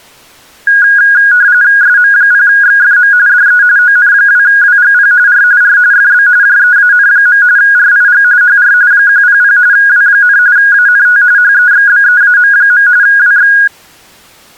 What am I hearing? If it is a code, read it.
RTTY (45.45 baud, 170 Hz shift), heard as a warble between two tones, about 1550 Hz centre. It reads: SM0XFM DE ON2WGP R R FB JEAN. RIG HR 100 W, ANT HEXBEAM. WX